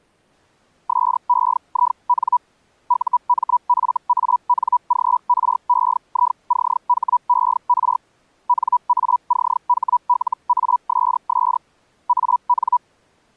Hellschreiber (Feld-Hell, 122.5 baud), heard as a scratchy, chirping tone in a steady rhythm, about 980 Hz. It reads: SEIN UMFANGREICHER NACHLASS AN